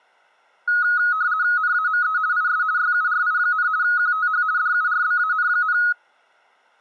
RTTY (50 baud, 170 Hz shift), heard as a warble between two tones, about 1360 Hz centre. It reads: NAME IS YURI, QTH DURBAN,